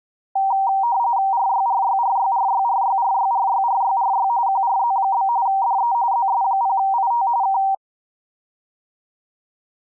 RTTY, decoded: RYRYRYRYRYRYRYRYRY QRZ? DE ZS0IT K

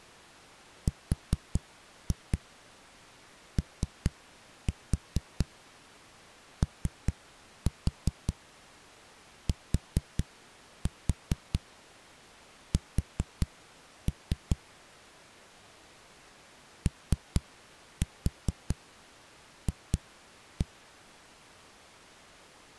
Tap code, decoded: ROOTS OF

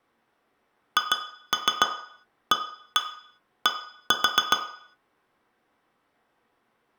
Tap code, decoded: HAD

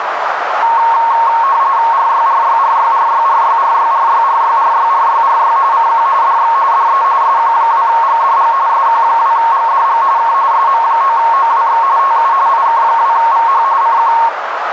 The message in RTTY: RYRYRYRYRYRYRYRYRYRYRY CQ DX DE SQ2GDG SQ2GDG K SM9OWX TU IK2VH CQ

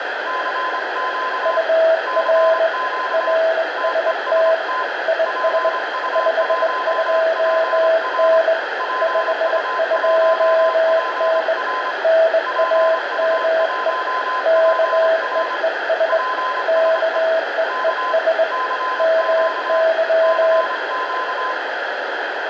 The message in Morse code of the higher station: CQ CQ TEST PU1PR PU1PR PU1PR PSE K CQ CQ

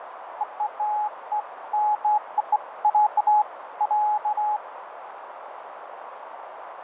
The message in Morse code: none

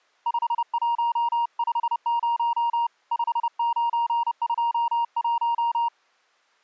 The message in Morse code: 5150 5921

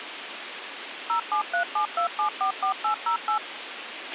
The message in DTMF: 07372744808

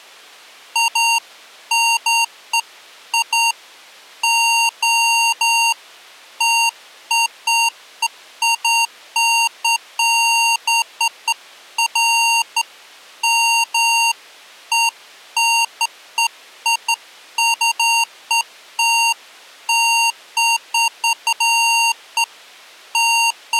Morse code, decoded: none

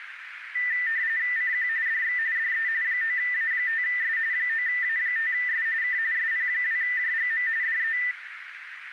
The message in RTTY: CQ DX DE 9A5S 9A5S K SP2JGM DE

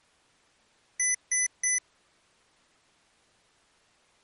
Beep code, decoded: 3 short

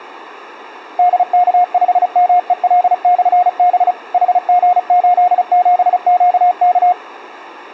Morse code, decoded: DK5MEL/B HG87QK

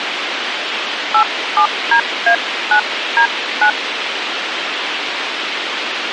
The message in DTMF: 87DA9D9

